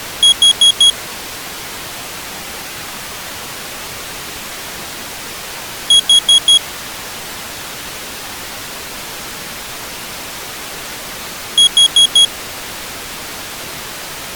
Alarm pattern, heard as an alarm's beeps, played three times, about 3300 Hz. Temporal four. Carbon monoxide.